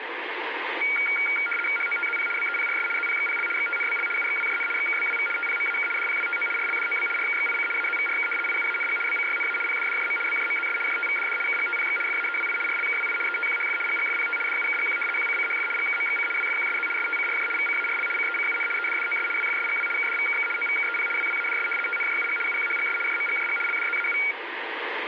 RTTY (75 baud, 850 Hz shift), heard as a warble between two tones, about 1850 Hz centre, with radio static. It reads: HOTZP BEPRS ZPXPL XTNBL UXWJN XKBWV TPMAK DPWTO RLDOB RKXIC AZVRK IUANG BCYNA PDDJM BJMZS JTVDD KGTPX FAEWI RLKWI ETQHF GGFPT DUKGQ QCCHF GKMXC WFQSZ STCRJ VCARL CECUN EDDOS WFSGW KDVKK OVKEP WWADS TNJUG UQHGS JMGJG LDZAU